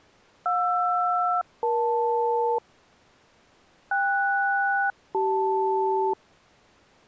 Aircraft SELCAL, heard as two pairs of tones. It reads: JR-EL KS-CL